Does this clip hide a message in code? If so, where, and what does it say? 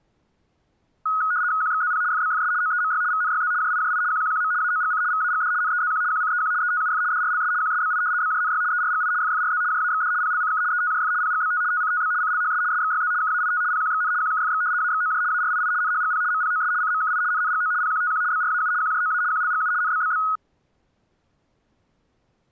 Yes: RTTY (75 baud, 170 Hz shift) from 1.1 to 20.4 s, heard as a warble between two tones, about 1360 Hz centre. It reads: QXZP FBFS OEMY VNYZ JIJI QQQM AOGC VAGD NEZQ QCEQ ETUF DRLS QSBI BJNY ERGI FFRZ JAXD PLCK ETJF PGBT TCTB CLHS SXYZ KAIT PQXN QKFX AXOJ ARII NHGP MPOS CMKI NNGO PQTQ BRAU QJOA QLGU NBBB